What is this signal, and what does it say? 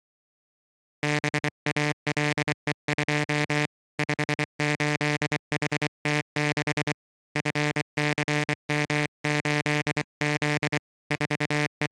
Morse code, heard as a buzzer, hand-sent with a paddle, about 24 wpm. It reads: BALE2 58HT6 FCM8Z …